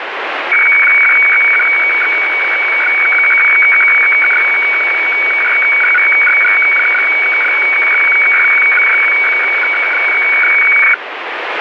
Weather fax (radiofax), 120 lines a minute, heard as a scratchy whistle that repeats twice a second, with radio static.